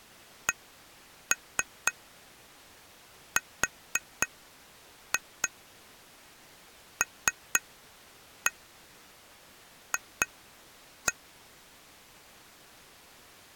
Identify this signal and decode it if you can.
Tap code, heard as taps on glass, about 3 knocks a second. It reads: CRLF